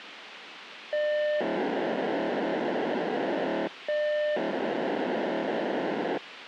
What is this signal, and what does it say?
POCSAG pager data (1200 baud), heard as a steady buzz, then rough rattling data, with radio hiss and a squelch burst at the end.